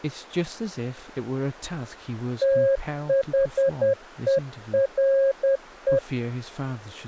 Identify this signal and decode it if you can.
Morse code, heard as a keyed tone, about 10 wpm, 540 Hz, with speech in English. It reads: THERE